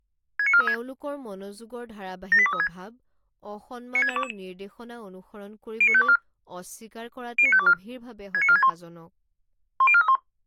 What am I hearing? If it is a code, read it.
Five-tone selective call (ZVEI), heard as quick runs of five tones, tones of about 70 ms, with speech in Assamese. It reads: 69436 78236 96622 09524 09524 69461 10431